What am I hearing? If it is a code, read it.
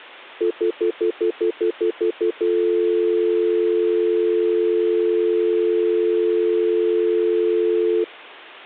Telephone call progress tone (North American plan), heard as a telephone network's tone, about 350, 440 Hz, 0.1 s on and 0.1 s off. Stutter dial tone.